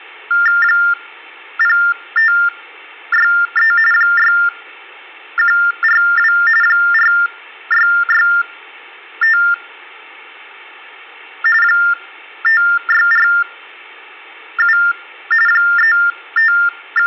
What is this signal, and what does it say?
TTY/TDD text telephone tones (45.45 baud Baudot), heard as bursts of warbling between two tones, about 400 Hz shift, 1600 Hz centre. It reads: 0563 6142 4665 5647 …